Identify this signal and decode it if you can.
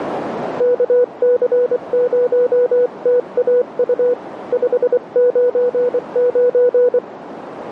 Morse code, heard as a keyed tone, hand-sent with a paddle, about 24 wpm, 490 Hz, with radio static and a narrow filter. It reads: KC0TAU 599